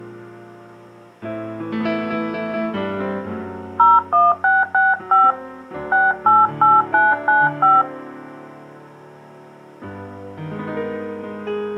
DTMF, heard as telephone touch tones, dialled by hand, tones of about 190 ms. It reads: 01665 688995